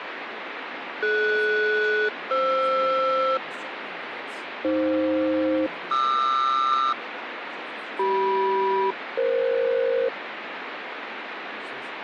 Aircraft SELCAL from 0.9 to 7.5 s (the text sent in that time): DS-FR AF-QR